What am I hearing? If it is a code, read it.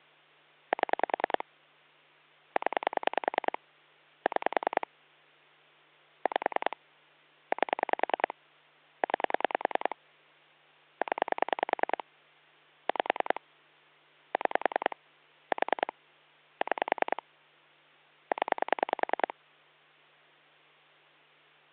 Pulse dialling, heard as clicks on a phone line, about 10 pulses a second, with hum. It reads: 7 0 6 5 8 9 0 5 6 4 6 0